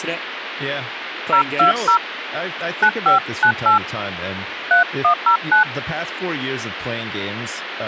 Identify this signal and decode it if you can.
DTMF, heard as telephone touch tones, dialled by hand, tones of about 100 ms, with phone line noise and speech in English. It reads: 020 9598 3109